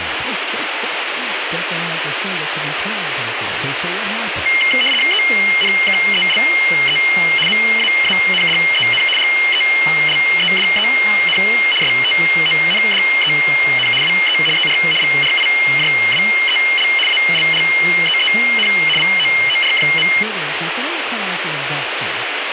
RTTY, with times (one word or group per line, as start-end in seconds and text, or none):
5.1-7.0 ENKELE
7.5-9.0 MAANDEN
9.2-11.4 GELEDEN
11.8-13.9 STONDEN
14.0-14.4 WE
14.6-14.8 ER
15.0-16.9 VRIJWEL
17.1-18.7 ALLEEN
19.0-20.1 VOOR.